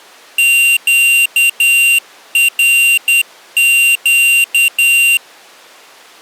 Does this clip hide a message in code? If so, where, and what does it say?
Yes: Morse code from 0.3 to 5.2 s, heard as a high beeper, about 10 wpm, 2750 Hz. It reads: QRQ